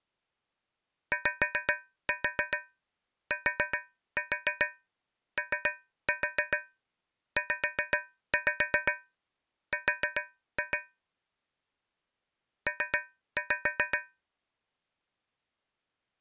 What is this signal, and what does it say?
Tap code, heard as taps on a metal pipe, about 7 knocks a second. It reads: YTOZR P